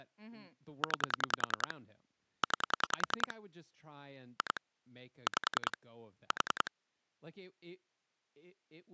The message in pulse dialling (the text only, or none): 9 9 2 5 4